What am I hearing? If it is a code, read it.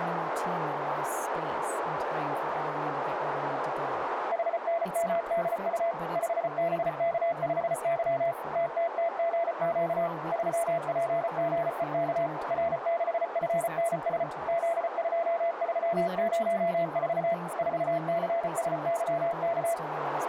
Morse code, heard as a keyed tone, machine-sent, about 34 wpm, 680 Hz, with radio static, a narrow filter and speech in English. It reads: HNMDU 5BK5Y TTTGQ 3PGEK R6FNS Z2304 4CSYK